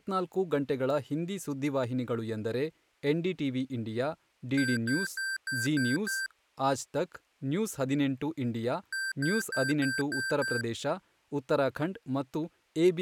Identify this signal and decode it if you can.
Beep code, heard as beeps from a small speaker, played twice, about 1550 Hz, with speech in Kannada. 6 short. In AMI BIOS tables: keyboard controller gate A20 failure; in Dell tables: video card failure.